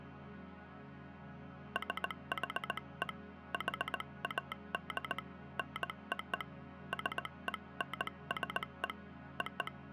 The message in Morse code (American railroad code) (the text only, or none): SHE HAD NO SENSE …